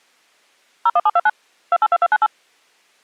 DTMF, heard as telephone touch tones, dialled by machine, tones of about 40 ms. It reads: 01729 282298